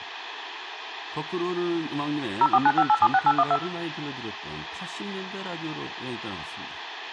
DTMF, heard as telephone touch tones, dialled by machine, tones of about 50 ms, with speech in Korean. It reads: 0495876812